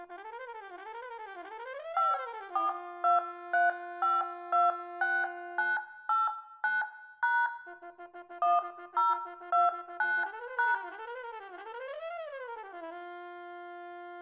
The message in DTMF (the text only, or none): 5423526989# 1029#